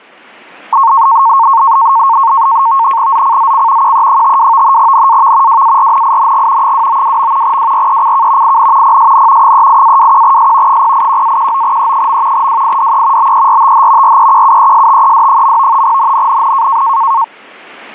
NAVTEX (SITOR-B), 100 baud, 170 Hz shift, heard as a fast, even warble, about 1000 Hz centre, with static crashes. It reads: ZCZC QE52 NAV WARNING 292. WRECK IN PSN 38-21S 081-19E. WIDE BERTH REQUESTED. NNNN